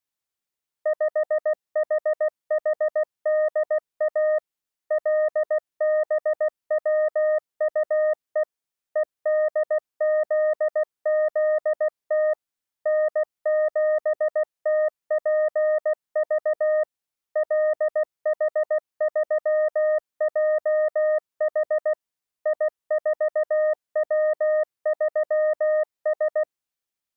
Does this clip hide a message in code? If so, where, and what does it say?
Yes: Morse code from 0.8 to 26.5 s, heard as a keyed tone, machine-sent, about 16 wpm, 620 Hz. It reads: 5HHDA LBWUE EDZZT N7TPV LH3JH I4W3S